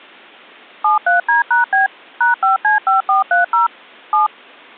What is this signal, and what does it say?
DTMF, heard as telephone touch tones, dialled by machine, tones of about 140 ms. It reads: 73D#B #5C5430 7